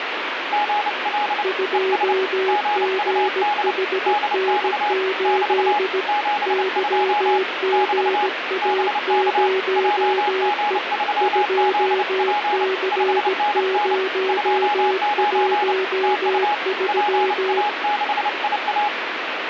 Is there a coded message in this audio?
Yes: Morse code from 0.5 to 18.9 s, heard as two keyed tones, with radio static. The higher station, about 29 wpm, 830 Hz: GL ES GUD DX <BT> 72 <BT> BK JG3ZP 5NN 29 TU PA6IA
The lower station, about 17 wpm, 380 Hz: 2GHN8 YGA0E 2C013